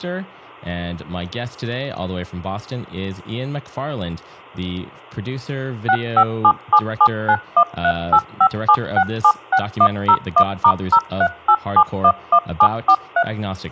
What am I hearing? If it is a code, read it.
DTMF, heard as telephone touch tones, dialled by machine, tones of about 70 ms, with speech in English. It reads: 65777913857676101*038711743